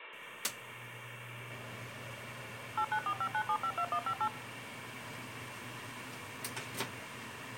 DTMF, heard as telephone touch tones, dialled by machine, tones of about 70 ms, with kitchen noise. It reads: 89459752158